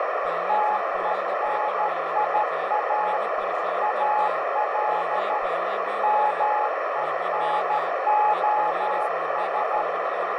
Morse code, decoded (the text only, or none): TENIA AL MENOS